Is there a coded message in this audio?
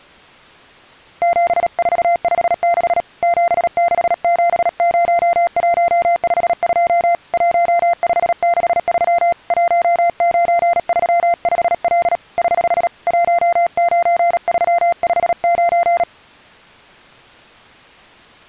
Yes: Morse code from 1.2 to 16.1 s, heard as a keyed tone, hand-sent with a paddle, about 37 wpm, 690 Hz. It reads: 7456 7670152 1563 1935L <HH> 19359